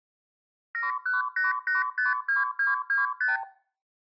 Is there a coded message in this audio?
Yes: multi-frequency trunk signalling (R2, with the far end's replies) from 0.7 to 3.4 s, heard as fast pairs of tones, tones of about 150 ms, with room echo. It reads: 718852225